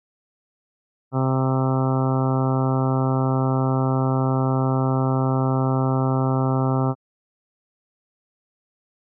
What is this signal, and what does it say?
Ship horn signal, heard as a ship's horn, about 130 Hz. 1 long. At sea: a vessel nearing a blind bend, or under power and making way in fog.